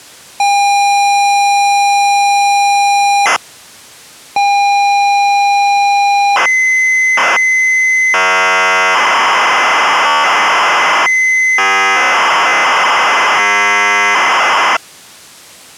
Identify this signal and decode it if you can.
ZX Spectrum tape loading, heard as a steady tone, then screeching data.